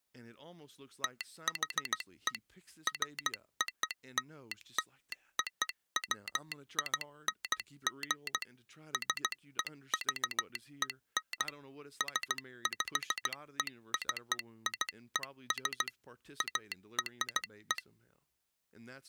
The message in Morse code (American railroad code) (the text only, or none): THE FOLLOWING SEVEN SPECIES ARE